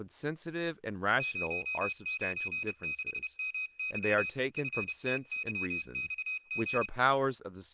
Morse code, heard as a high beeper, hand-sent with a paddle, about 30 wpm, 2500 Hz, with speech in English. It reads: 096MY FTYXG